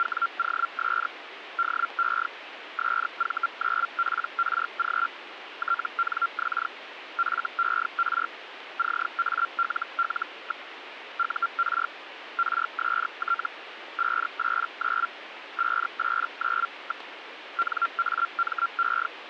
Hellschreiber (Feld-Hell, 122.5 baud), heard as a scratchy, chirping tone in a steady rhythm, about 1380 Hz, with radio static. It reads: … DE SV9PRG TNX FER CALL. UR RST 589 589. NAME